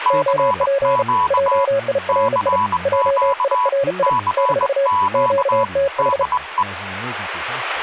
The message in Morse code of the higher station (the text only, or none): CQ CQ CQ DE